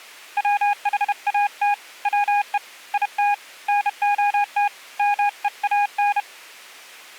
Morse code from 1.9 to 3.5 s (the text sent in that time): WE IT